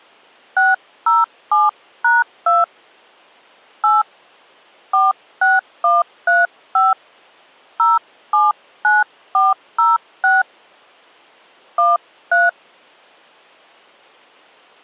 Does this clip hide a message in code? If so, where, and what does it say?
Yes: DTMF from 0.6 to 12.5 s, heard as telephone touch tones, dialled by hand, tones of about 180 ms. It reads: 607#2 8 46135 079406 13